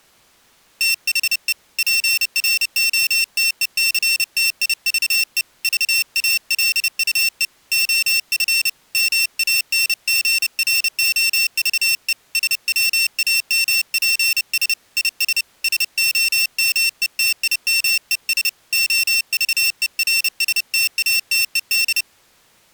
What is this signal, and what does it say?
Morse code, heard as a high beeper, hand-sent with a paddle, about 30 wpm, 2700 Hz. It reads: THE PROTECTIVE VALUE OF MANGROVE SWAMPS IS SOMETIMES OVERSTATED